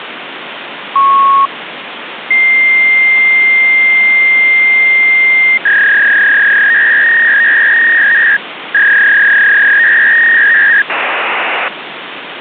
Fax machine handshake, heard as a beep, a long tone, a warble and hiss, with phone line noise.